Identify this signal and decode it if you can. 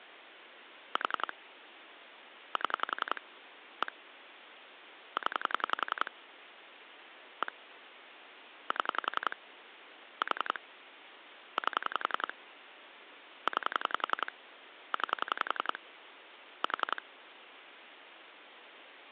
Pulse dialling, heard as clicks on a phone line, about 11 pulses a second, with phone line noise. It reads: 4 7 1 0 1 7 4 8 9 9 4